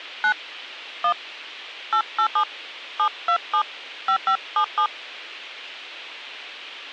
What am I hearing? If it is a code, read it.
DTMF, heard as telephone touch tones, dialled by hand, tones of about 80 ms. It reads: 9 1 887 727 5577